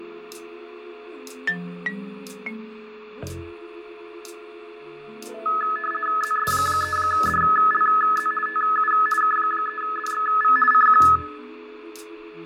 RTTY (50 baud, 450 Hz shift), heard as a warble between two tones, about 1500 Hz centre, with radio static, fading, a steady whistle near 430 Hz and room echo. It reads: ZS3DLZ TU K3DXV CQ